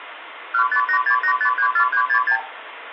Multi-frequency trunk signalling (R2, with the far end's replies), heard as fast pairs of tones, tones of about 90 ms, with phone line noise. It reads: 15868534366